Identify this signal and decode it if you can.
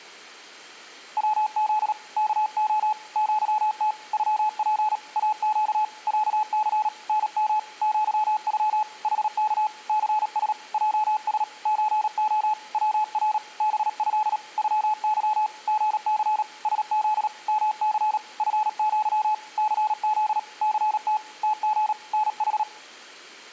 Morse code (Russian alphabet), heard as a keyed tone, hand-sent with a paddle, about 37 wpm, 860 Hz. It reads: ВЗ КО ЪТ ЮП АЩ ЯЦ НМ ЪЮ ХК ЦС ЙС ЧО ВР БЭ ЮЫ ГЦ СЗ МЦ ФЪ ЦЗ ЦТ ТГ НХ